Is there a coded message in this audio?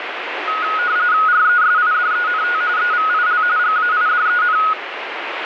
Yes: RTTY (45.45 baud, 170 Hz shift) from 0.5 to 4.7 s, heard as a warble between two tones, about 1360 Hz centre, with radio static. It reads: RESIDENT EVIL GAIDEN